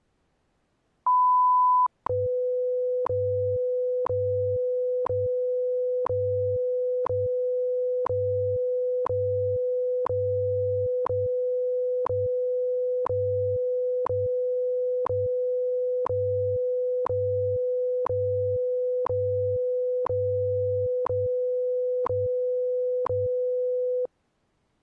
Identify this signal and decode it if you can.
Radio time signal (WWV, Colorado), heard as ticks, one a second.